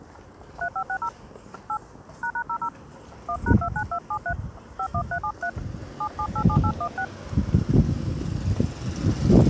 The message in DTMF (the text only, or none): 3560 8 ##00 1#29273 51373 7787816